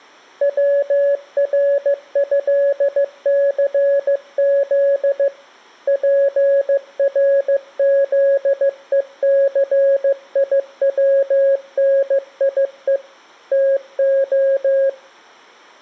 Morse code (with Polish letters), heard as a keyed tone, hand-sent with a paddle, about 15 wpm, 550 Hz, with room echo. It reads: WRĘCZ PRZECIWNIE TO